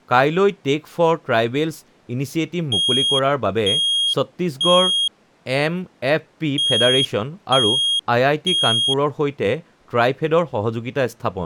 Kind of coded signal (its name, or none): alarm pattern